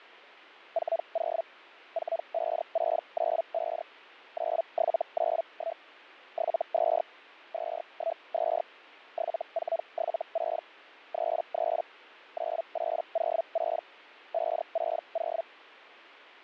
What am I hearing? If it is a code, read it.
Hellschreiber (Feld-Hell, 122.5 baud), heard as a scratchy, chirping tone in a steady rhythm, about 660 Hz, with fading. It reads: 40 45695 9791 72 212 7476 33 9806 560